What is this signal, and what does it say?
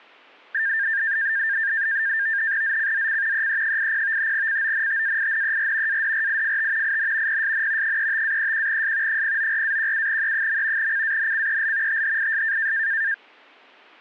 NAVTEX (SITOR-B), 100 baud, 170 Hz shift, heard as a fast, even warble, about 1700 Hz centre. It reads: ZCZC EE80 CONTAINER ADRIFT IN PSN 35-31S 094-17E. CANCEL THIS